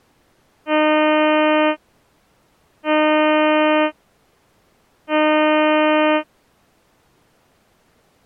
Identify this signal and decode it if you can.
Ship horn signal, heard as a ship's horn, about 310 Hz. 3 short. At sea: I am operating astern propulsion.